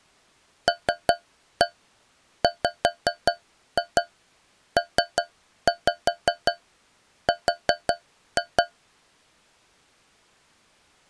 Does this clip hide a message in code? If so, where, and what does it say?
Yes: tap code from 0.7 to 8.7 s, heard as taps on a metal pipe, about 5 knocks a second. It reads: LWPR